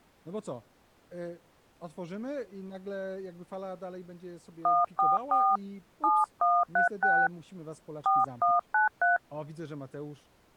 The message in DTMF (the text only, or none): 144 7136 4193